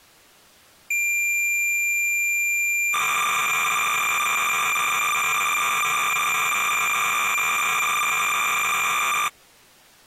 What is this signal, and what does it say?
Cassette data (Kansas City type), 300 baud, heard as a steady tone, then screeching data.